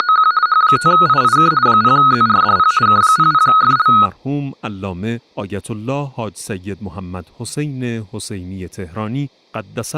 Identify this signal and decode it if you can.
RTTY (50 baud, 170 Hz shift), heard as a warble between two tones, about 1360 Hz centre. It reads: … H5IIK 0ZRDP K00FL